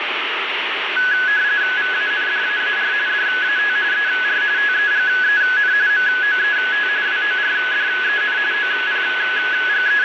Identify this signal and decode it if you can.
RTTY (45.45 baud, 170 Hz shift), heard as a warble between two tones, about 1600 Hz centre, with radio static. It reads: VANDAAR DAT ER TEGEN MOET WORDEN …